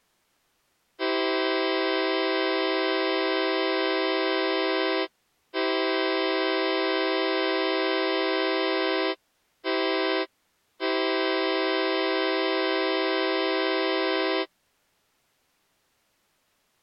Train horn signal, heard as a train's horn. 2 long, 1 short, 1 long. On North American railways: approaching a public crossing.